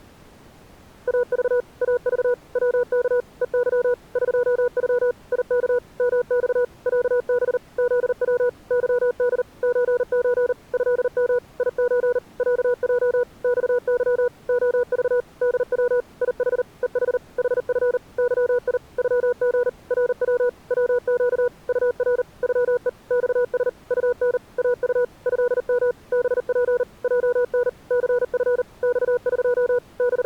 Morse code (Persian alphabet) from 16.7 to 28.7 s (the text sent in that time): هح حف ظی غژ رو وگ طر غه خس طن اط ضم بپ جن ثف